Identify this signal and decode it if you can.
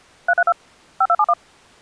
DTMF, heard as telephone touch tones, dialled by machine, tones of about 50 ms. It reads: 332 5271